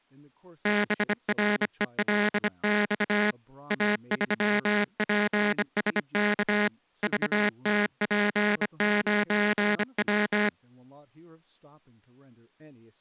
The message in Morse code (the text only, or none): BRELX A3PSK VTP9W